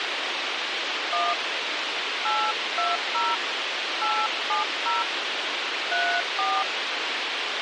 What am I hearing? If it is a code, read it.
DTMF, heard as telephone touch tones, dialled by hand, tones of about 210 ms, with radio hiss. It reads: 1 820 870 34